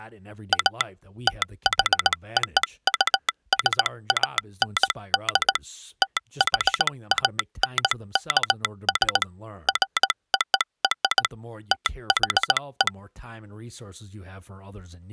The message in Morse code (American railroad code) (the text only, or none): A THOUSAND THANKS FOR THE